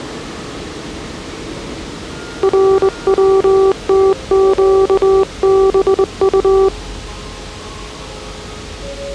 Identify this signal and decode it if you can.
Morse code (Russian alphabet), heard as a keyed tone, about 22 wpm, 390 Hz, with the noise of a subway station. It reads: РВТЩБУ